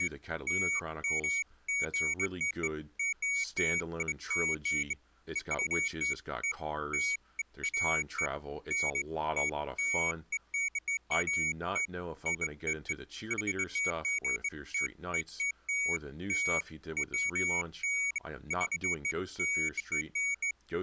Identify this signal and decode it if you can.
Beeps of irregular length, with speech in English. There is no code.